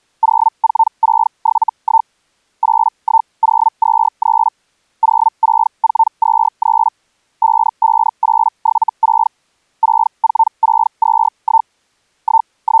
Hellschreiber (Feld-Hell, 122.5 baud), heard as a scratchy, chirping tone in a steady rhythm, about 900 Hz. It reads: 04671 81023 06423 55876 64621 …